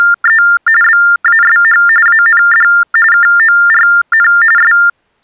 TTY/TDD text telephone tones (45.45 baud Baudot), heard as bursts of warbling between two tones, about 400 Hz shift, 1600 Hz centre. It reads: … BASH AND KORN …